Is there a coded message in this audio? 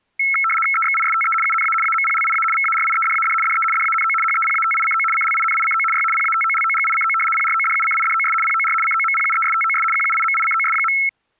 Yes: RTTY (75 baud, 850 Hz shift) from 0.2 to 11.1 s, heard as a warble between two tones, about 1750 Hz centre. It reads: EXISTE UNA AMPLIA VARIEDAD DE DANO HEPATICO CLINICO Y PATOLOGICO PRODUCIDOS POR COMPUESTOS QUIMICOS.